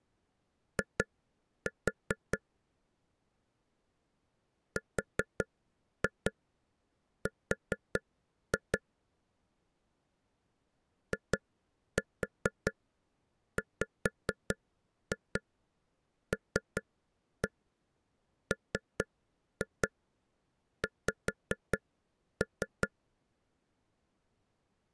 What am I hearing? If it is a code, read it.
Tap code, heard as taps on a table, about 4 knocks a second. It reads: I RR IWLMX